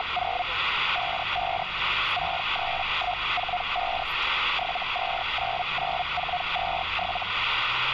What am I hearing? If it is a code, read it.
Hellschreiber (Feld-Hell, 122.5 baud), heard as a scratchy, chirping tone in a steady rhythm, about 720 Hz, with radio static and street noise. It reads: … 55 63145 7299427